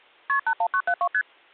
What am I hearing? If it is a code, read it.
Multi-frequency trunk signalling (R1, as on North American trunks), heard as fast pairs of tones, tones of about 70 ms. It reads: KP 81972 ST